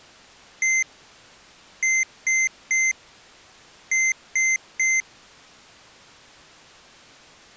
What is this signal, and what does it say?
Beep code, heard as beeps from a small speaker, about 2100 Hz. 1-3-3. In Phoenix BIOS tables: chip or data line failure in the first 64 KB of memory.